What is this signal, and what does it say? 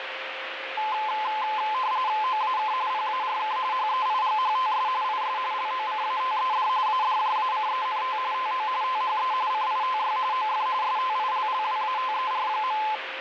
RTTY (45.45 baud, 170 Hz shift), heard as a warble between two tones, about 950 Hz centre, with radio static and a steady whistle near 530 Hz. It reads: OAK PARK HEIGHTS IS LOCATED ADJACENT TO THE CITY OF STILLWATER.